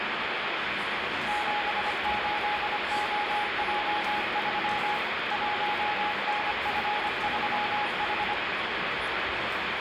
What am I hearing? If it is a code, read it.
Morse code, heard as a keyed tone, machine-sent, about 25 wpm, 830 Hz, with heavy radio static, room echo and the noise of a crowd indoors. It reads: 78OJ3 1NF3H